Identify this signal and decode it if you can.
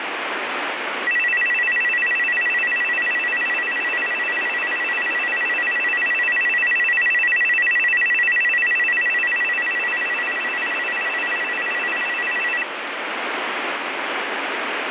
A tone that alternates evenly between two pitches, with radio static. There is no code.